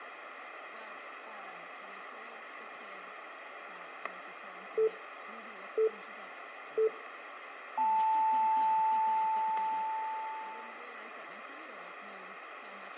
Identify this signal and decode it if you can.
Radio time signal (three low pips and a long one an octave up, as on NHK), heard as pips, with static crashes and speech in English.